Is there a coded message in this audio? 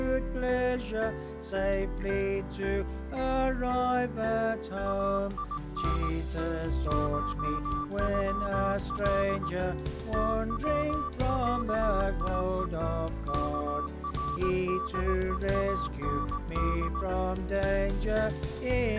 Yes: Morse code (Persian alphabet) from 4.8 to 17.1 s, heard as a keyed tone, hand-sent with a paddle, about 18 wpm, 1160 Hz. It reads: این شغل توصیه کردهاند